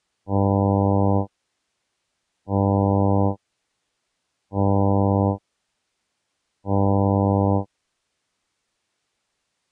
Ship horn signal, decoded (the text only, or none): 4 short